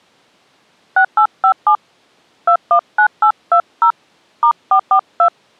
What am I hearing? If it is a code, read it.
DTMF, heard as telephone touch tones, dialled by hand, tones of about 80 ms. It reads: 6857 219820 *442